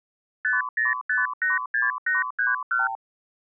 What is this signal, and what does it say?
Multi-frequency trunk signalling (R2, with the far end's replies), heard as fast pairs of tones, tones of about 160 ms. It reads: 50586831